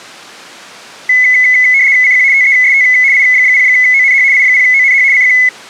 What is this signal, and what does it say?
RTTY (75 baud, 170 Hz shift), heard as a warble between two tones, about 2100 Hz centre. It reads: CQ TEST I0ONH I0ONH CQ